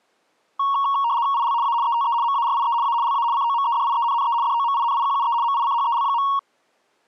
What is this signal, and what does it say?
RTTY (75 baud, 170 Hz shift), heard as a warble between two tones, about 1020 Hz centre. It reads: IL A ETE MARIE A LA COMEDIENNE DOMINIQUE MICHEL.